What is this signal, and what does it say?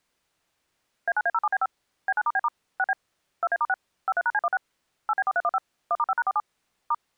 DTMF, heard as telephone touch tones, dialled by machine, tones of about 40 ms. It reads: A9A07B5 B9*B* 6B 2A*6 53#C16 8B4315 1*5#47 *